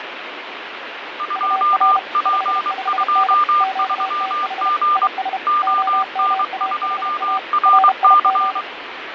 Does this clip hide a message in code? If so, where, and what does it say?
Yes: Morse code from 1.1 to 8.7 s, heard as two keyed tones, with radio static and fading. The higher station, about 23 wpm, 1200 Hz: 2P23G ON2RC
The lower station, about 32 wpm, 760 Hz: UR 55N QTH IS OMAHA RIG